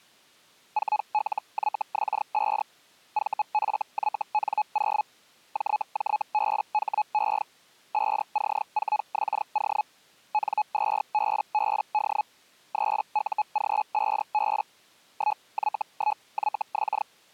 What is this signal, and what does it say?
Hellschreiber (Feld-Hell, 122.5 baud), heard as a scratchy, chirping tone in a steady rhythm, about 850 Hz. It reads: 4LYX5 VFYN0 JJBHE 5C4XO N2BBD 3UG5B 1Y1YX